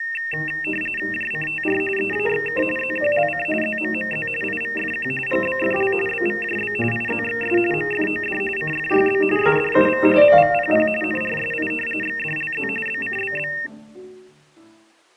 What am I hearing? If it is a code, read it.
RTTY (45.45 baud, 850 Hz shift), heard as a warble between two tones, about 2250 Hz centre. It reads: JCTR EAXK ZQLC ZMMZ IVFQ GBFL BVJB IZXS MFOD CFYB SDUV MVPP NRSI XDLZ BCBB